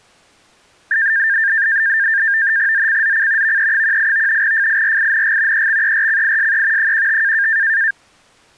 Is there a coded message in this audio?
Yes: NAVTEX (SITOR-B), 100 baud, 170 Hz shift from 0.9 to 7.9 s, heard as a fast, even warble, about 1700 Hz centre. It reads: ZCZC VE18 FIRING EXERCISE 15